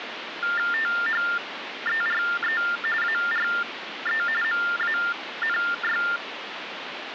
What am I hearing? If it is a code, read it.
TTY/TDD text telephone tones (45.45 baud Baudot), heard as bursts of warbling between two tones, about 400 Hz shift, 1600 Hz centre, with phone line noise. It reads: THERE ARE MANY